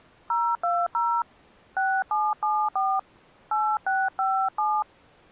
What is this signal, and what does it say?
DTMF, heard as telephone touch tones, dialled by hand, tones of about 240 ms. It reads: 020 6774 8657